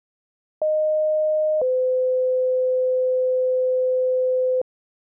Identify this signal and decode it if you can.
Two-tone page, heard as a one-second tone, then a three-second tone, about 620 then 510 Hz.